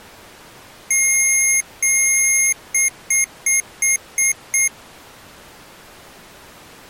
Beep code, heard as beeps from a small speaker, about 2150 Hz. 2 long, 6 short.